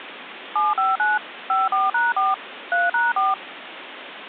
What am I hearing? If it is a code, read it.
DTMF, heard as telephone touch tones, dialled by machine, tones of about 180 ms, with phone line noise. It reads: 759 54#4 3#4